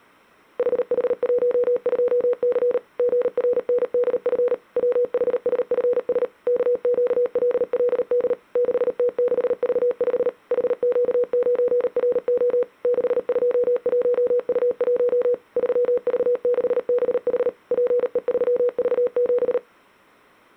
Morse code, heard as a keyed tone, machine-sent, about 38 wpm, 490 Hz. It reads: HH12C GRNDF WHSFS KQLLD 6T6V5 HQ9RO 621U1 3V6BH PE3V7